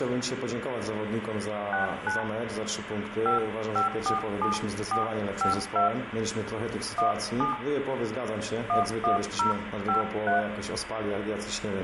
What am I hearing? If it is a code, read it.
DTMF, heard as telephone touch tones, dialled by hand, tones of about 130 ms, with phone line noise and room echo. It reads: 69 5547452 17 11053